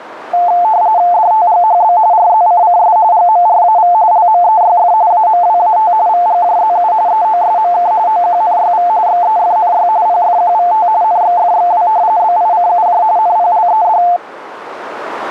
RTTY (45.45 baud, 170 Hz shift), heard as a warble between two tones, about 790 Hz centre, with radio static. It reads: DTGHB RZCCS GMRAV LMEYF AMWAT VGJZU EOSMK OQNYV XEFNY PFQVT NXFXW BICUJ NPLED